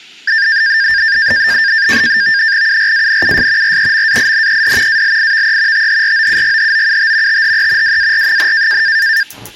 NAVTEX (SITOR-B), 100 baud, 170 Hz shift, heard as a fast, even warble, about 1700 Hz centre, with kitchen noise. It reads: URANUS REMAINED ALIVE THROUGHOUT THE WAR,